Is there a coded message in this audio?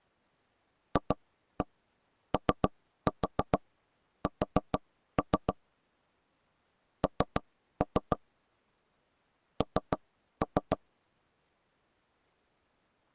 Yes: tap code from 1.0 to 10.8 s, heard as knocks on wood, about 6 knocks a second. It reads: FOS N N